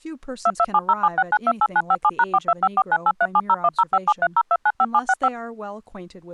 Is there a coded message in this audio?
Yes: DTMF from 0.5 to 5.3 s, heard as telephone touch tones, dialled by machine, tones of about 50 ms, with speech in English. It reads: 227076928957#425498370105730295765